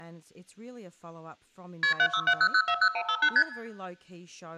Multi-frequency trunk signalling (R1, as on North American trunks), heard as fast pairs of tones, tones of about 70 ms, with room echo and speech in English. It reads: KP 7670040158 ST